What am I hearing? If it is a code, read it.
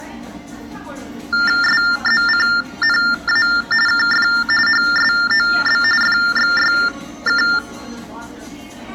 TTY/TDD text telephone tones (45.45 baud Baudot), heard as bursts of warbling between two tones, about 400 Hz shift, 1600 Hz centre, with room echo and the noise of a cafe. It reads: SZCNA KF HSOB FXYK